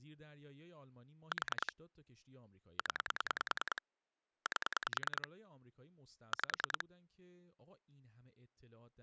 Pulse dialling, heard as clicks on a phone line, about 10 pulses a second, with speech in Persian. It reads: 4 0 8 5